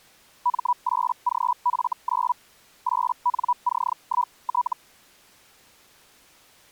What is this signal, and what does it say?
Hellschreiber (Feld-Hell, 122.5 baud), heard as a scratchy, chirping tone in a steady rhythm, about 980 Hz. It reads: M8GF9 8NC1T